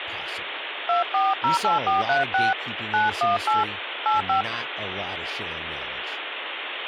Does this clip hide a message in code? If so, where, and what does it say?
Yes: DTMF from 0.9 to 4.4 s, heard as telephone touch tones, dialled by hand, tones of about 160 ms, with phone line noise and speech in English. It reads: 2408436 918 85